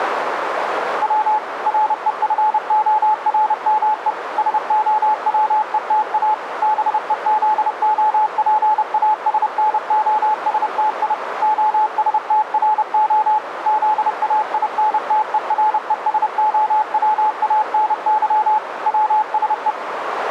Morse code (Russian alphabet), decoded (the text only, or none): В РЕФОРМЕ СОВЕТА БЕЗОПАСНОСТИ ОСТРО ЗАИНТЕРЕСОВАНЫ ВСЕ